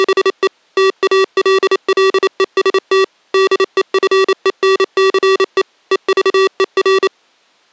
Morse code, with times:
0.0-0.5 …
0.8-3.0 TALLEST
3.3-5.6 DEFENCE
5.9-7.1 EVER

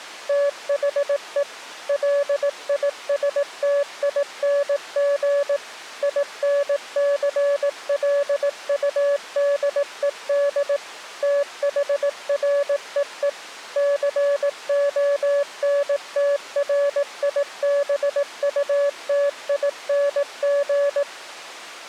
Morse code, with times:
0.3-1.4 THE
1.9-5.6 LISTING
6.0-10.8 INCLUDED
11.2-13.3 THREE
13.8-21.0 CONTRIBUTING

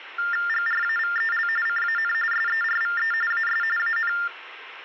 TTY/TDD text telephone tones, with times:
0.5-1.5 GRAVEL
1.7-2.1 CAN
2.3-3.1 SERVE
3.3-3.6 AS
3.8-4.1 AN

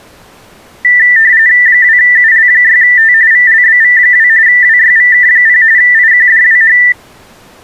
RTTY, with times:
1.7-3.1 2UL6T
3.3-4.3 VLBV2
4.5-5.6 WYVK0
5.8-6.8 IQDWH

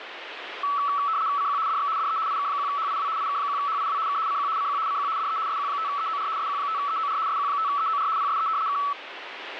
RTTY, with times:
1.4-1.6 CQ
1.7-1.9 DX
2.0-2.2 DE
2.3-3.1 IK1HIW
3.2-4.0 IK1HIW
4.1-4.2 K
4.3-4.5 CQ
4.6-4.8 CQ
4.9-5.1 CQ
5.2-5.4 DE
5.5-6.3 SQ5EOR
6.4-7.2 SQ5EOR
7.3-8.1 SQ5EOR
8.2-8.5 PSE
8.7-8.8 K

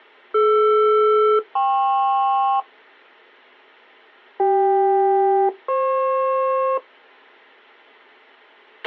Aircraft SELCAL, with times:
0.3-2.6 DR-KP
4.4-6.8 CK-FP

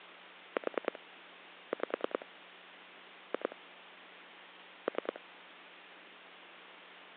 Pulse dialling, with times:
0.6-1.0 4
1.7-2.3 5
3.3-3.6 2
4.9-5.2 3

